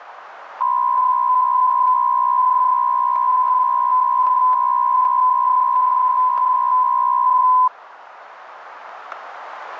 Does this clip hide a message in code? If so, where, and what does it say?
Yes: PSK63 (62.5 baud) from 0.6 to 7.7 s, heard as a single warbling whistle, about 1010 Hz, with radio static and static crashes.